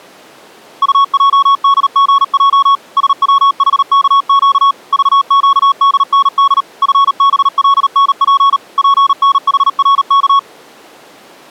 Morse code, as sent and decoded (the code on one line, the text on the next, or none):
..- .--- -.. --. .--- / ... .-- .... -.- --.- / ...- --.- -.. -. -.. / ..-. -... .-.. -. .--. / .--. -. .... .-. -.-
UJDGJ SWHKQ VQDND FBLNP PNHRK